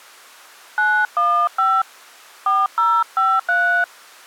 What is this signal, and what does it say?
DTMF, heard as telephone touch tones, dialled by hand, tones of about 280 ms. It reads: 915 4053